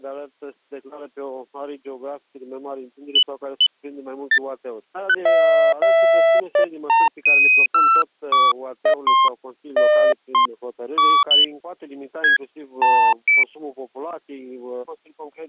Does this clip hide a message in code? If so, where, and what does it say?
No, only electronic bleeps of random pitch and length.